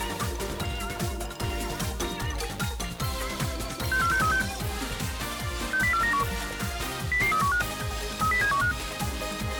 Five-tone selective call (CCIR), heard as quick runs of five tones, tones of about 100 ms. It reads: 64636 60491 00315 30715